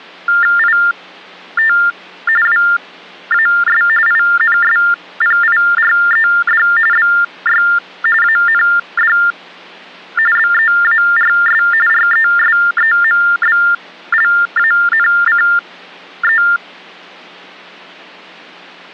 TTY/TDD text telephone tones (45.45 baud Baudot), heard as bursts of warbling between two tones, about 400 Hz shift, 1600 Hz centre. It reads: IT WAS INSPIRED BY AND BEARS RESEMBLANCE